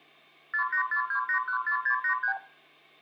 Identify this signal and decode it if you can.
Multi-frequency trunk signalling (R2, with the far end's replies), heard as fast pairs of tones, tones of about 90 ms, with hum and room echo. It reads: 4842814683